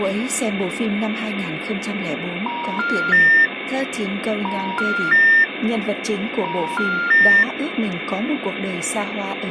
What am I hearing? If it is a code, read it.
Telephone call progress tone (ITU plan), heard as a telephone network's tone, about 950, 1400, 1800 Hz, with phone line noise and speech in Vietnamese. Special information tone.